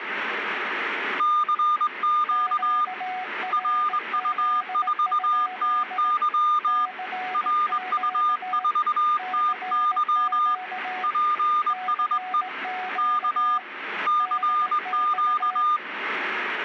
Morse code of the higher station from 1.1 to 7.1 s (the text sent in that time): CQ RU4TY